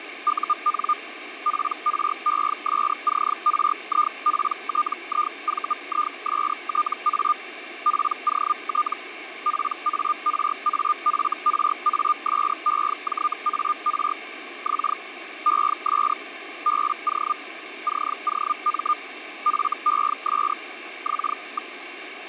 Hellschreiber (Feld-Hell, 122.5 baud), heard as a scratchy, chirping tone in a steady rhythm, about 1210 Hz, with radio static. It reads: UN PRESCRIPTIVISTA POT PARAFRASEJAR X ES BO COM FES X.